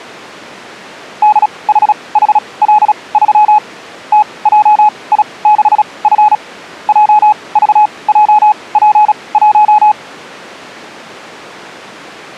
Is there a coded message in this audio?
Yes: Morse code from 1.2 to 10.0 s, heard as a keyed tone, machine-sent, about 36 wpm, spaced as for 24 wpm, 850 Hz. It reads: DHHL3 TJI6F JVJP1